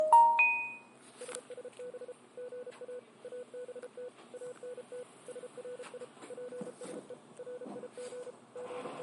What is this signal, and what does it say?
Morse code, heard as a keyed tone, machine-sent, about 33 wpm, 500 Hz, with the noise inside a bus. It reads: SSB GA ABT ANT SRI PSE RIG …